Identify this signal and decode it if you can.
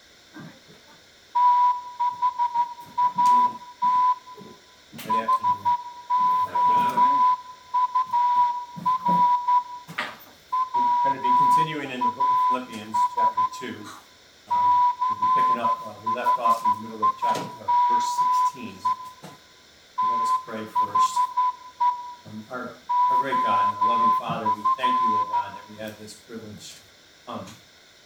Morse code, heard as a whistle, hand-sent with a straight key, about 12 wpm, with room echo. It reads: THAT HOUR WAS CHIME THE OF